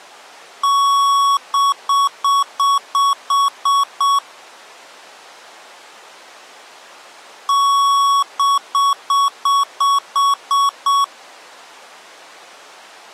Beep code, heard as beeps from a small speaker, played twice, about 1120 Hz. 1 long, 8 short. In AMI BIOS tables: display or retrace test failure.